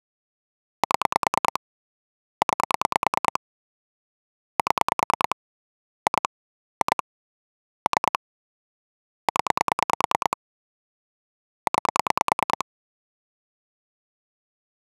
Pulse dialling, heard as clicks on a phone line, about 9 pulses a second. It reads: 7 9 7 2 2 3 0 9